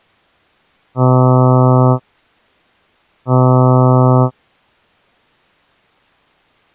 Ship horn signal, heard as a ship's horn, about 130 Hz. 2 short. At sea: I am altering course to port.